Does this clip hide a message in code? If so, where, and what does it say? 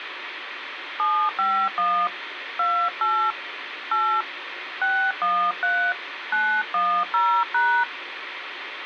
Yes: DTMF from 1.0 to 7.8 s, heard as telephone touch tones, dialled by hand, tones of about 290 ms, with radio hiss. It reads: 751 28 8 613 910#